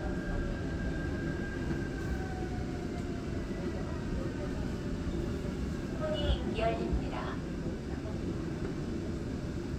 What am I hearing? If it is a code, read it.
The noise inside a subway train. There is no code.